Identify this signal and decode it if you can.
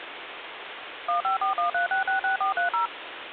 DTMF, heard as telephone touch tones, dialled by machine, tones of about 120 ms, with phone line noise. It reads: 15413666430